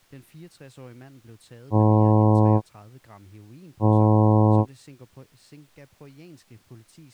Ship horn signal, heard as a ship's horn, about 110 Hz, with speech in Danish. 2 short. At sea: I am altering course to port.